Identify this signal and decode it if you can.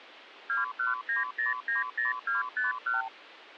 Multi-frequency trunk signalling (R2, with the far end's replies), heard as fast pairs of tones, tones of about 150 ms. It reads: 219090251